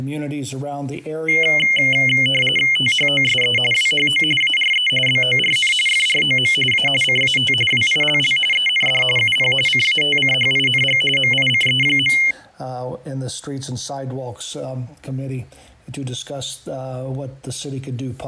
RTTY (45.45 baud, 850 Hz shift), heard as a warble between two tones, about 2550 Hz centre. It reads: THOSE WHO ARE BORN FROM A CAT WILL END UP CATCHING MICE.